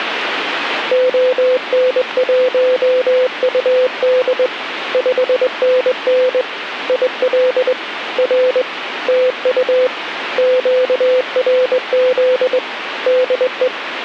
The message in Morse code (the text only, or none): ON1UD 5NN IL R TU QRZ DE